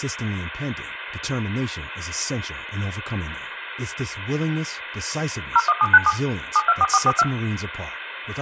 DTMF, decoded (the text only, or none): 01797 724442